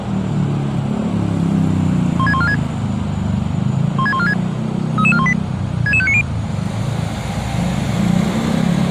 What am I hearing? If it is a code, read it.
Five-tone selective call (ZVEI), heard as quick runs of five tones, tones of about 70 ms, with street noise. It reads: 16146 16146 33418 66590